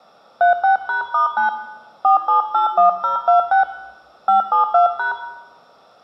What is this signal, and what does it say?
DTMF, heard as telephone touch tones, dialled by hand, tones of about 120 ms, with room echo. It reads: 36#*9 4781026 572#